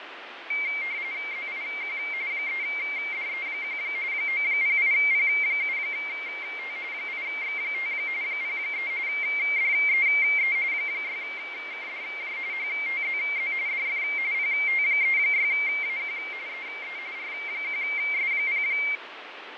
RTTY (45.45 baud, 170 Hz shift), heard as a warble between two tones, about 2200 Hz centre, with radio static and fading. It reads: ZIQ 3DE1 908P7T 8X5 03 DEE 6KDJ HTZZ DF PT36AQ EE R1S0